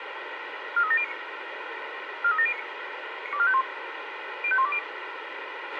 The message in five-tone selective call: 43709 43709 92451 05120

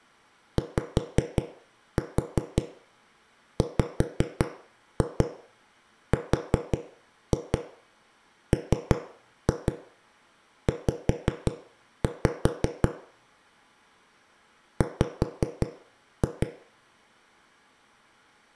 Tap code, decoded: YWRMZ W

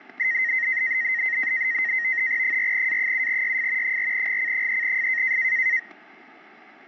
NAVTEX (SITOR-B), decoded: 4A7YF 4GC3F

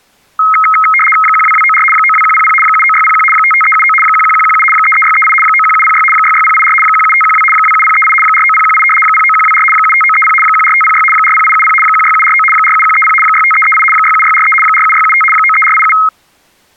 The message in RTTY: 12294 92100 79601 55379 11117 33638 91706 66084 17512 27038 49018 09124 75930 14506 40870 16749 47130 65338 67643 47675 93487

